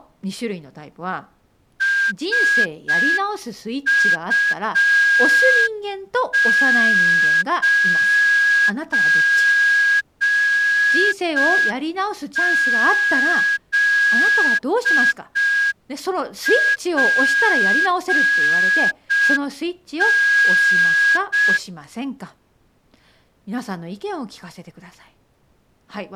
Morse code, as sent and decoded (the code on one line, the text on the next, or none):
... ..- ----. --.. .--. -.
SU9ZPN